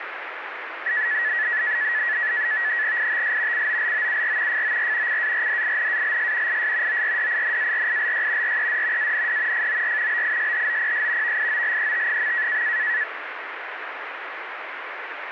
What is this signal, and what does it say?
NAVTEX (SITOR-B), 100 baud, 170 Hz shift, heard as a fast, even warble, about 1800 Hz centre, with radio static. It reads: ITS COLOUR FOR CARDINALS IS ORDINARILY RED AND FOR BISHOPS VIOLET.